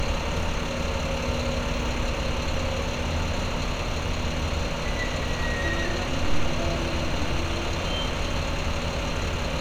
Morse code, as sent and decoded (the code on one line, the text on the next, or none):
none